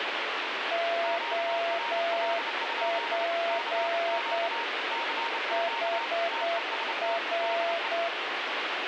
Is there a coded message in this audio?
Yes: Morse code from 0.7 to 8.1 s, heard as two keyed tones, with radio static. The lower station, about 8 wpm, 680 Hz: OP HR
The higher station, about 29 wpm, 930 Hz: QRL? CQ CQ TEST DE